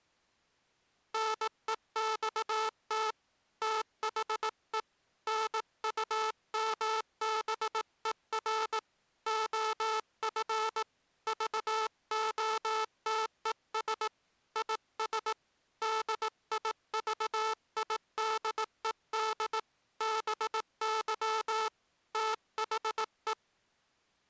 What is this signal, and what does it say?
Morse code, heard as a buzzer, hand-sent with a paddle, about 18 wpm. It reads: NEXT THE NUMBER OF VOTES IS DIVIDED BY THE